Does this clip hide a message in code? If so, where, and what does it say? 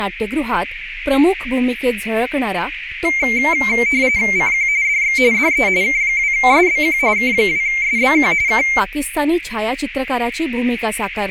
Yes: RTTY (45.45 baud, 170 Hz shift) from 3.0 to 8.8 s, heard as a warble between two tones, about 2200 Hz centre, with radio static, a narrow filter and speech in Marathi. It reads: CQ DX DE K2SBQ K2SBQ K